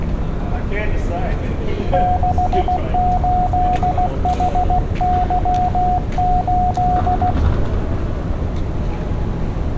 Morse code, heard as a keyed tone, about 16 wpm, 730 Hz, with street noise. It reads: 68HY8